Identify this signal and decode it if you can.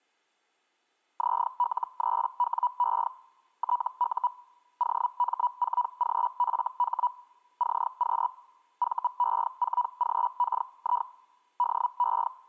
Hellschreiber (Feld-Hell, 122.5 baud), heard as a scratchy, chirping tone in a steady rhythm, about 980 Hz. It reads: ZL3WE TU OM4GFH CQ VE4GKI DE